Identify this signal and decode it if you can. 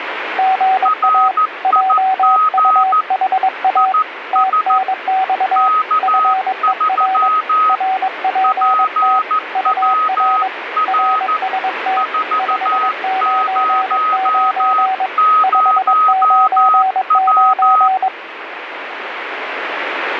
Morse code, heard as two keyed tones, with radio static. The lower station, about 22 wpm, 760 Hz: GA JUHA TNX FER RPT UR RST 599 599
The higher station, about 14 wpm, 1260 Hz: RIG IS K3 PWR 400W